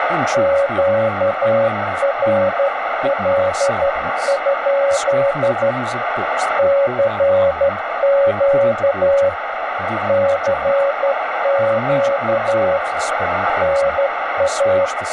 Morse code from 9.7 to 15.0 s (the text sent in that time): CQ NA